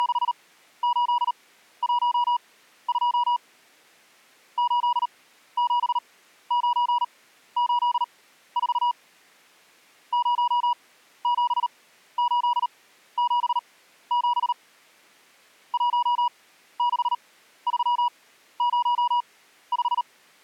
Morse code, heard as a keyed tone, machine-sent, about 38 wpm, spaced as for 14 wpm, 970 Hz. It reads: … 87984 07877 16305